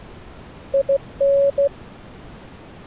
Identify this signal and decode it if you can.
Morse code, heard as a keyed tone, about 15 wpm, 560 Hz. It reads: IN